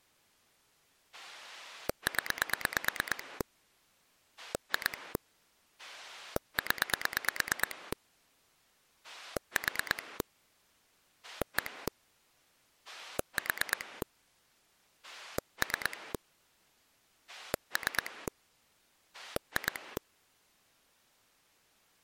Pulse dialling, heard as a rotary dial, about 9 pulses a second. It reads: 0 2 0 4 1 4 3 3 2